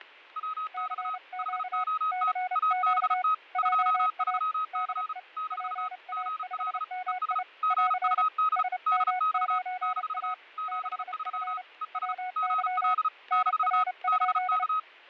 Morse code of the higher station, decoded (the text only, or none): WX HOT ABT 23C - GL ES GUD DX - 73 ES GL - BK